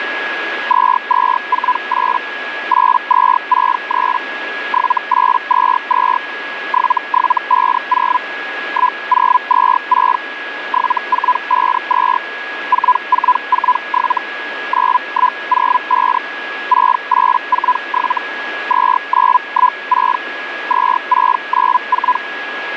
Hellschreiber (Feld-Hell, 122.5 baud), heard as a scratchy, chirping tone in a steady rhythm, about 1000 Hz, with radio static and a steady whistle near 1660 Hz. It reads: 2248 8263 7822 7750 1026 7452 4447 9105 6847 2916 2694